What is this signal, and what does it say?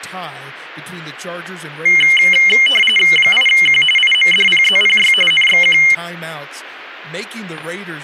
RTTY (45.45 baud, 850 Hz shift), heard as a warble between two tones, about 2550 Hz centre, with speech in English. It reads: 8Q IMDPZPY NXQ